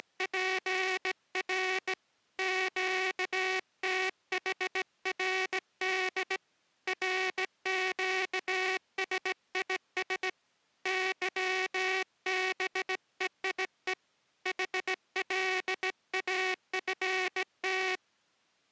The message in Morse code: … QTHRD RQSIS YBEIE HLAFT

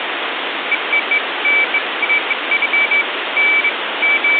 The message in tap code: none

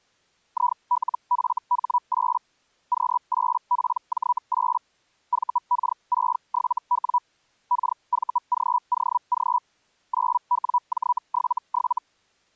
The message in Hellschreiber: ILFH8 Q8PJ8 VK67W KVGOG 9WJ77

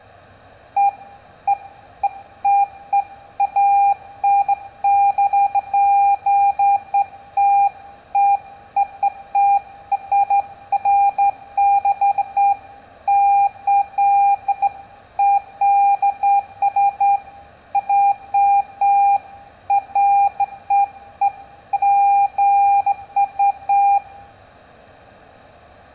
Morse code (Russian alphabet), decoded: none

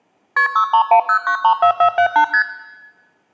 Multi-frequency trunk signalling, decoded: KP 6310934478 ST

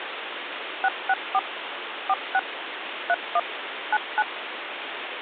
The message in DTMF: 664 46 31 99

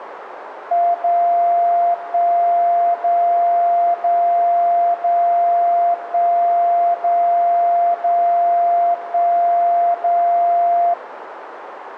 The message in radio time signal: 0 1 0 0 0 1 0 0 1 0

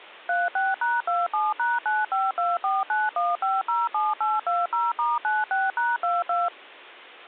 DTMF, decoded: 36#27#952491507820*96#22

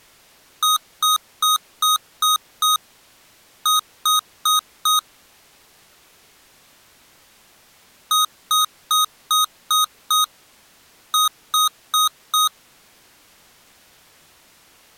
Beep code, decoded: 6-4

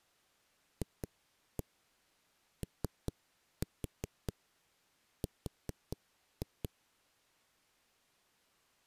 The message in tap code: FOR

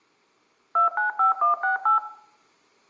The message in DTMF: 295168

